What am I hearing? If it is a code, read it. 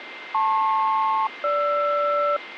Aircraft SELCAL, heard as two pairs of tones, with radio static and a steady whistle near 2090 Hz. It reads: LP-GR